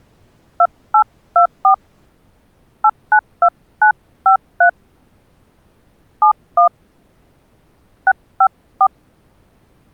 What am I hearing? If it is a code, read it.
DTMF, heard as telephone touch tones, dialled by hand, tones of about 80 ms. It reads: 2824 892953 71 654